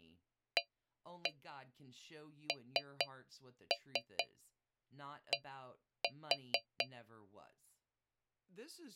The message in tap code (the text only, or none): AND